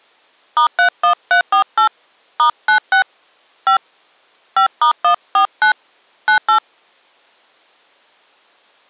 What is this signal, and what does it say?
DTMF, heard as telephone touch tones, dialled by hand, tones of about 100 ms. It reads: *31348 *96 5 5*149 98